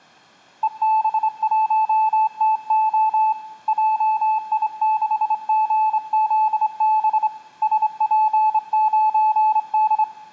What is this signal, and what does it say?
Morse code, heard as a keyed tone, hand-sent with a straight key, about 26 wpm, 870 Hz, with room echo. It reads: EB1TO JI6GZB SP9D